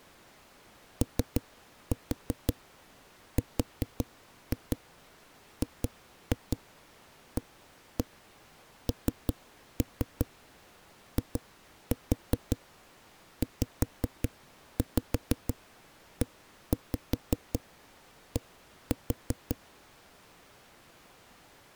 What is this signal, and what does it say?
Tap code, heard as knocks on a wall, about 5 knocks a second. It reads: ORGANIZED